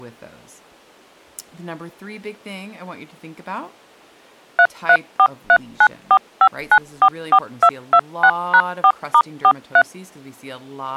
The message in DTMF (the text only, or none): 3343945944226#4*43